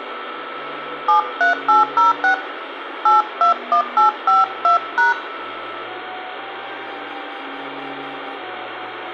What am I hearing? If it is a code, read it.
DTMF, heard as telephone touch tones, dialled by hand, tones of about 130 ms, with phone line noise and room echo. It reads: 73806 821852#